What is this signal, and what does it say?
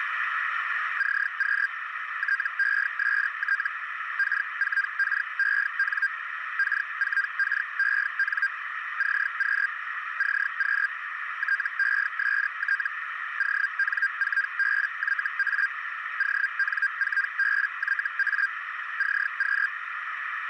Hellschreiber (Feld-Hell, 122.5 baud), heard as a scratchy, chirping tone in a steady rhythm, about 1600 Hz, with radio static and a narrow filter. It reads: CQ TEST K4KEN K4KEN CQ CQ TEST ON4BYA ON4BYA CQ